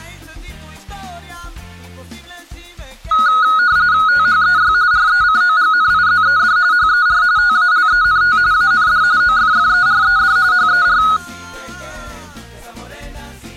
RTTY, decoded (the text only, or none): THEY RECOGNIZED HER TALENT AND OFFERED HER